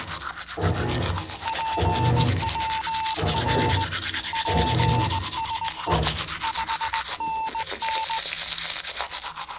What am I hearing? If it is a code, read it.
Morse code, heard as a keyed tone, hand-sent with a straight key, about 19 wpm, 890 Hz, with the noise of a restroom. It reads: PWR PSE 5NN